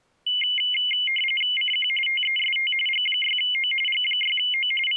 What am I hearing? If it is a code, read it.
RTTY (45.45 baud, 850 Hz shift), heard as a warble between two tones, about 2550 Hz centre. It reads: CQ TEST G6O G6O …